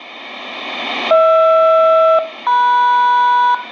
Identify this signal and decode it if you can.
Aircraft SELCAL, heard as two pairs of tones, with room echo. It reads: HR-MS